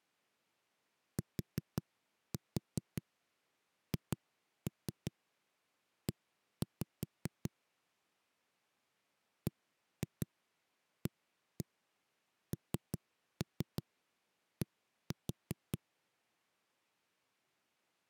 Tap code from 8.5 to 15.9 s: BAND

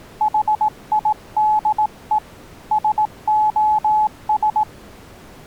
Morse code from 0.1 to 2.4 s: HIDE

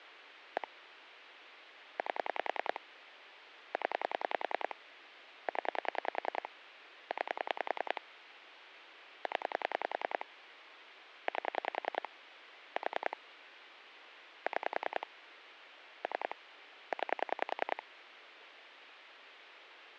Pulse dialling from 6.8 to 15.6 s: 9 0 8 4 6

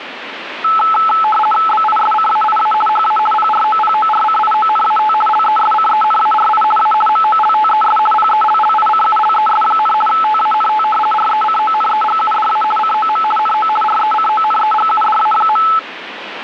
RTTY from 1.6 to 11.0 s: BISCAIA HA PROPORCIONAT LESCENARI A MOLTES PELLICULES, TANT

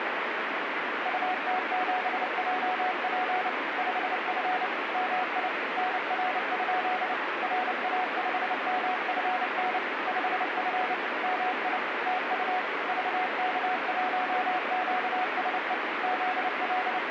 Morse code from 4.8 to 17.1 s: MI NR? RA5MFN 5F MI TU VK1QSE …

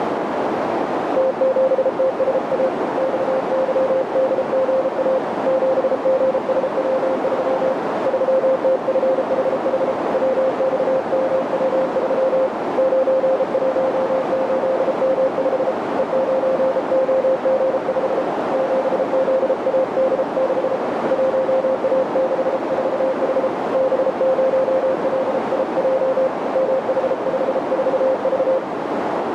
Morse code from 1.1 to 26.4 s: T7TSA XYDGA 7GSW3 3TFHH WXMW3 918M5 E9OG5 7ZAD6 1A64H B0LIJ

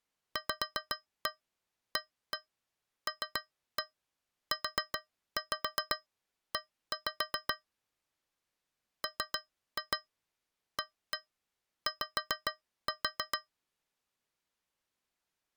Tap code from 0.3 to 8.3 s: VALUE

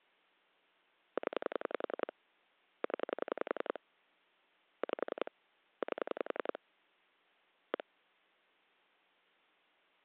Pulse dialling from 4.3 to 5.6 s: 5

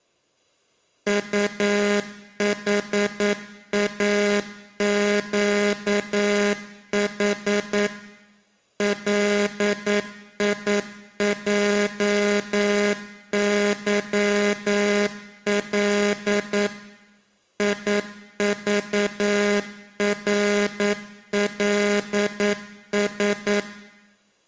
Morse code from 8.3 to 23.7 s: LIJYL IVRLS

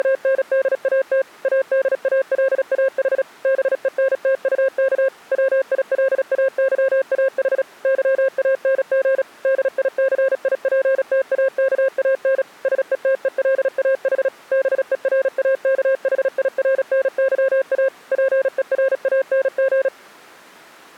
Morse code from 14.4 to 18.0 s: BERAKHIRNYA

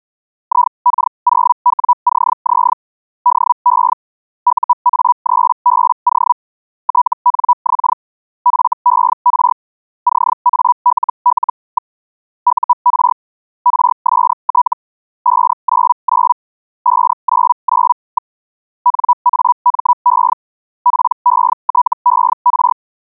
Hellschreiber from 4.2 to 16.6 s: UA3BO TNX FER CALL. UR RST 599

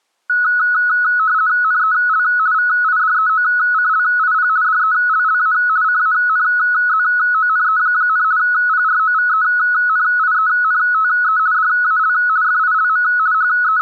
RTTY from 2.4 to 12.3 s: VIDEOCLIP DELLA CANZONE, PROVENIENTE DAL

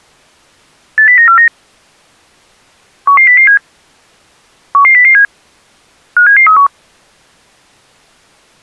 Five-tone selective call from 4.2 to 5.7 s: 11007

